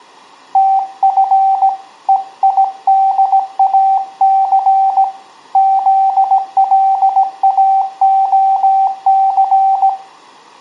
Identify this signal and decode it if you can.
Morse code, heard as a keyed tone, hand-sent with a paddle, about 17 wpm, 780 Hz, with room echo. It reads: TF EIDAC ZLAOC